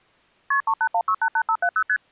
Multi-frequency trunk signalling (R1, as on North American trunks), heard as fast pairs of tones, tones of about 70 ms. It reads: KP 381688570 ST